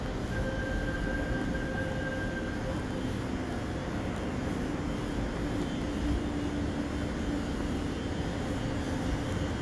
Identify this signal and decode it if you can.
The noise of a subway station. There is no code.